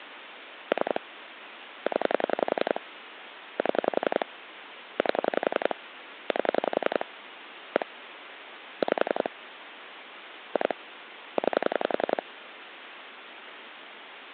Pulse dialling, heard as clicks on a phone line, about 11 pulses a second, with phone line noise. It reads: 3 0 7 8 8 1 5 2 9